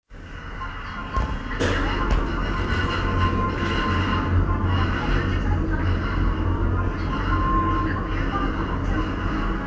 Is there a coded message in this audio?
No, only the noise inside a lift.